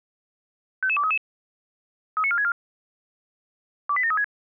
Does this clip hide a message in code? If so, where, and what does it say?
Yes: five-tone selective call (ZVEI) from 0.8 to 4.2 s, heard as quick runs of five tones, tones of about 70 ms. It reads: 55233 39464 28736